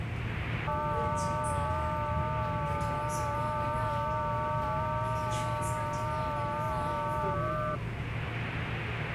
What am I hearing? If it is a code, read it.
FT8 (several signals at once), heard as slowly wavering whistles, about 6.25 baud, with radio static and the noise inside a subway train.